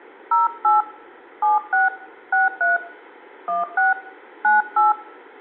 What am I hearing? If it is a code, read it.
DTMF, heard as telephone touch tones, dialled by hand, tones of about 160 ms, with room echo. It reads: 08 76 63 16 98